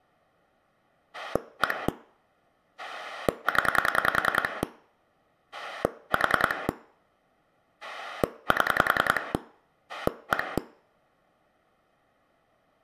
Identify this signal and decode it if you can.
Pulse dialling, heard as a rotary dial, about 10 pulses a second, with room echo. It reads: 1 0 4 7 1